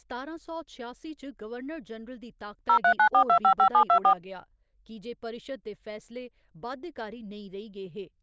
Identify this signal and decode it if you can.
DTMF, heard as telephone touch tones, dialled by machine, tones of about 80 ms, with speech in Dogri. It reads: 0394255724